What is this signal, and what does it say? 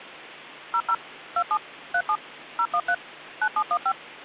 DTMF, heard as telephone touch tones, dialled by machine, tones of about 70 ms. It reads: 00 27 37 013 9715